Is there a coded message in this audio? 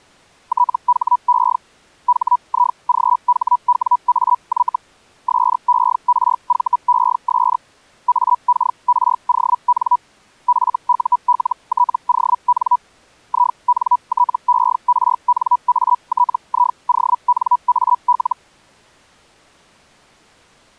Yes: Hellschreiber (Feld-Hell, 122.5 baud) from 0.5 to 18.4 s, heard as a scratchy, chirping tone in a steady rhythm, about 980 Hz. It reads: THE HIGHWAY SERVES AKRON FULTON INTERNATIONAL